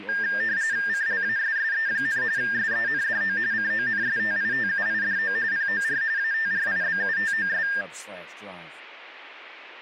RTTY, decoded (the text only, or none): CLASSE, SENDO CONSTITUIDO POR ATRIBUTOS